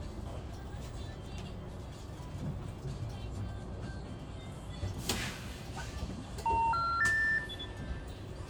Telephone call progress tone (North American plan), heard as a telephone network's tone, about 910, 1370, 1800 Hz, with room echo and the noise inside a bus. Special information tone.